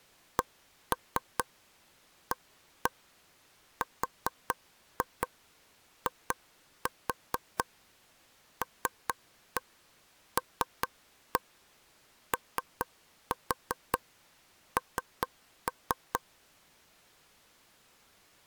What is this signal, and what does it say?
Tap code, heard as taps on a table, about 4 knocks a second. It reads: CARILLON